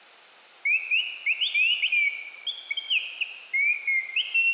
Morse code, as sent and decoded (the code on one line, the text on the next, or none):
none